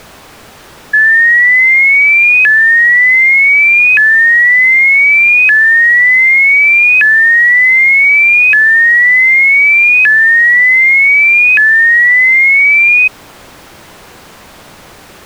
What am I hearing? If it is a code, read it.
A tone that sweeps in pitch again and again. There is no code.